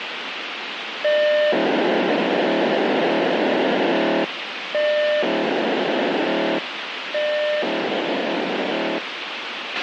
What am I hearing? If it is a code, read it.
POCSAG pager data (1200 baud), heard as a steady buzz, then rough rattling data, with radio hiss and a squelch burst at the end.